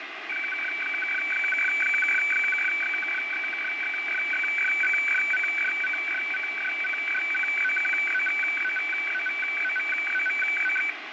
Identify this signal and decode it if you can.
Weather fax (radiofax), 120 lines a minute, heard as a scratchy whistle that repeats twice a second, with radio static.